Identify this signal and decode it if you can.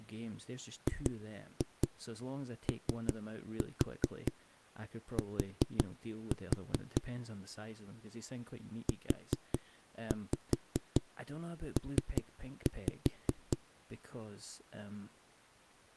Tap code, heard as knocks on a wall, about 5 knocks a second, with speech in English. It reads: GOT UP